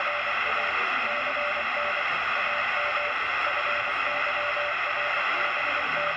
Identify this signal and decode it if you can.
Morse code, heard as a keyed tone, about 24 wpm, 590 Hz, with heavy radio static and the noise of a cafe. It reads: … CN AM …